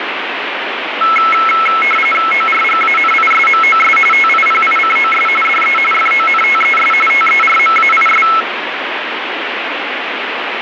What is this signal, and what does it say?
RTTY (45.45 baud, 850 Hz shift), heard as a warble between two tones, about 1750 Hz centre, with radio static. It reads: ORGANISMOS TIPICOS DE FONTES TERMAIS